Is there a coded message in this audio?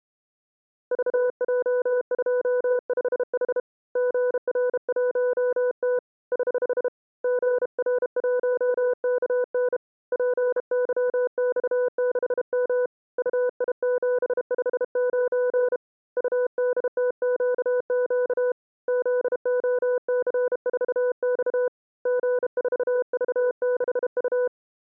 Yes: Morse code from 0.9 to 24.5 s, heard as a keyed tone, hand-sent with a bug key, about 32 wpm, 500 Hz. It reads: VJ25H GR1T <HH> GR1KN PYX6M UI759 UDTQQ ZOC4X G4V6U